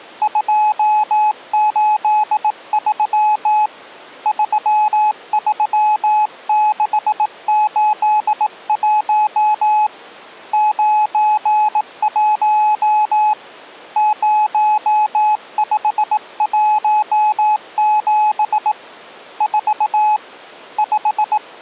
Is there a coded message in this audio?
Yes: Morse code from 0.2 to 21.4 s, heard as a keyed tone, hand-sent with a bug key, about 18 wpm, 850 Hz. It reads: 283 33681 91 0517 4 5